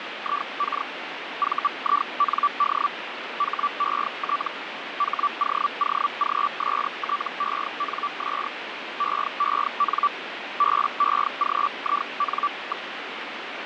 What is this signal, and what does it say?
Hellschreiber (Feld-Hell, 122.5 baud), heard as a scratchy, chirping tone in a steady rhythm, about 1160 Hz, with radio static. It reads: IK VIND HET HOOGSTENS EEN BEGIN.